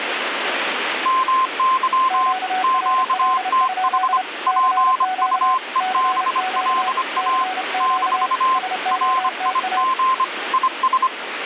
Morse code, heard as two keyed tones, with radio static. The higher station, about 25 wpm, 1040 Hz: MY QTH PUEBLA - RIG IS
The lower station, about 30 wpm, 750 Hz: QRL? CQ CQ CQ SOTA